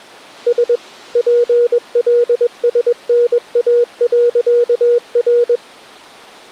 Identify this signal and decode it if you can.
Morse code, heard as a keyed tone, machine-sent, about 21 wpm, 480 Hz. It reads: S PLSNA.R